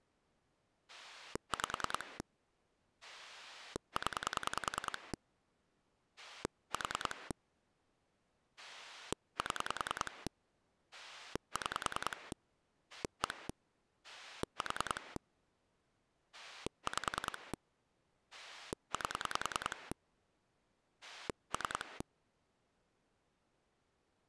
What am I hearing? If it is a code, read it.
Pulse dialling, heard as a rotary dial, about 10 pulses a second. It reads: 5 0 4 7 6 1 4 5 8 3